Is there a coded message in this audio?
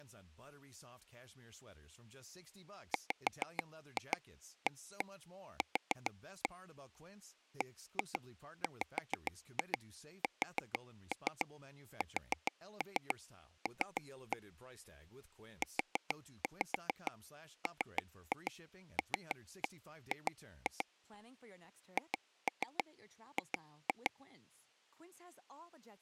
Yes: tap code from 2.9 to 24.1 s, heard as taps on a table, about 6 knocks a second, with speech in English. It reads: WAQ BWSSL UMLG HG